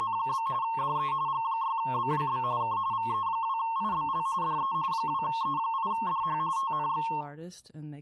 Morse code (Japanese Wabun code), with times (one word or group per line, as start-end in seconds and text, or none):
none